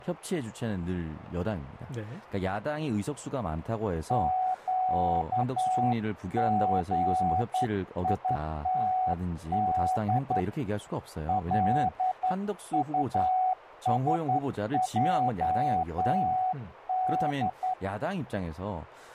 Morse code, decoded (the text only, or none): QGITD LUSJD